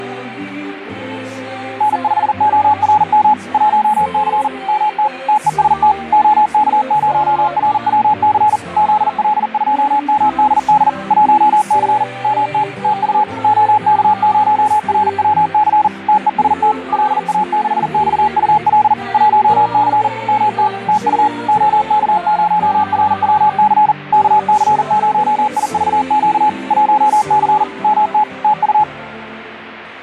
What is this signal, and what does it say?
Morse code, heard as a keyed tone, machine-sent, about 40 wpm, 850 Hz. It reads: N5ORM 1C MT TEST OK0RWC ZL2MDD 1C MT TU OK0RWC TEST LA6XUL 1C MT TU OK0RWC KC0IVQ 1C MT TU